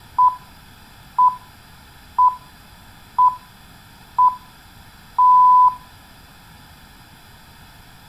Radio time signal (six pips, as the Greenwich Time Signal), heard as pips, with room echo.